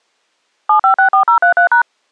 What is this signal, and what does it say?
DTMF, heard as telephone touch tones, dialled by machine, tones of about 100 ms. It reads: 7564033#